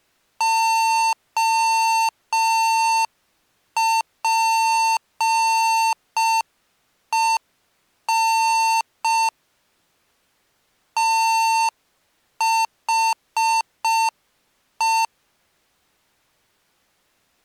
Morse code, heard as electronic beeps, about 5 wpm, 900 Hz. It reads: OPEN THE